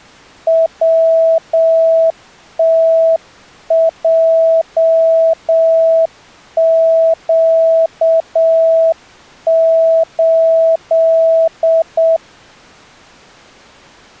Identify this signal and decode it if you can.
Morse code, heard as a keyed tone, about 7 wpm, 650 Hz. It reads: WTJQ8